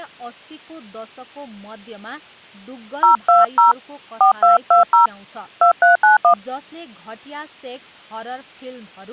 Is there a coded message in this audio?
Yes: DTMF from 3.0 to 6.3 s, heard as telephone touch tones, dialled by hand, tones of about 130 ms, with speech in Nepali. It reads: 020 4220 2391